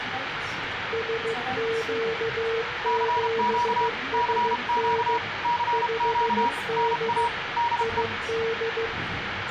Morse code, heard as two keyed tones, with radio static and the noise inside a subway train. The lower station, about 15 wpm, 450 Hz: SQ7SN 5D ID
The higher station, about 32 wpm, 960 Hz: CQ CQ CQ NA DE